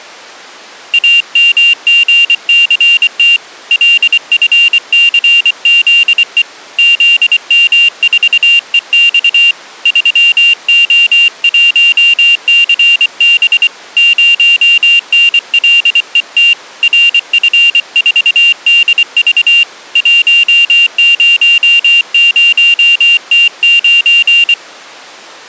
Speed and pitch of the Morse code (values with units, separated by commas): 24 wpm, 2800 Hz